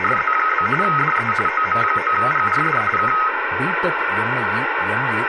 RTTY (45.45 baud, 850 Hz shift), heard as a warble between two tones, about 1700 Hz centre, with radio static and speech in Tamil. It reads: … DE OM9GRD K